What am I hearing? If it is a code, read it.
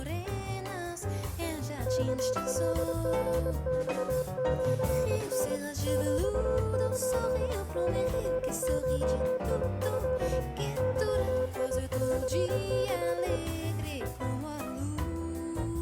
Morse code (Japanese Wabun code), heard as a keyed tone, hand-sent with a straight key, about 23 wpm, 510 Hz, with room echo. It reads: ワカリマシタ ヒル シゴト ゲンキ